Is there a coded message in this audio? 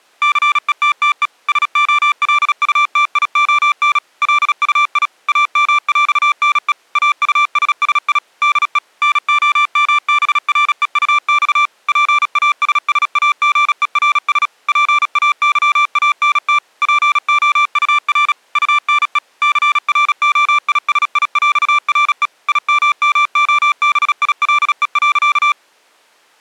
Yes: Morse code (with French letters) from 0.2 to 25.6 s, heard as electronic beeps, machine-sent, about 36 wpm, 1180 Hz. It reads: CETTE SOLUTION LUI AMÈNE AUSSI DE NOMBREUX PASSAGERS PAYANT POUR UNE CROISIÈRE IMMOBILE.